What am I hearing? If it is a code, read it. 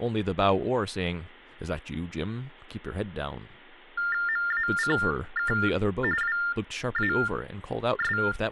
TTY/TDD text telephone tones (45.45 baud Baudot), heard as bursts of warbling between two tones, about 400 Hz shift, 1600 Hz centre, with speech in English. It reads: MACK WAS